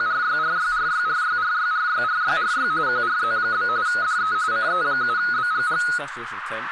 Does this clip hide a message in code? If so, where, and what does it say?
Yes: RTTY (45.45 baud, 170 Hz shift) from 0.0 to 6.0 s, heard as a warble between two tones, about 1360 Hz centre, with radio static, a narrow filter and speech in English. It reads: … QRZ? DE CE7BGG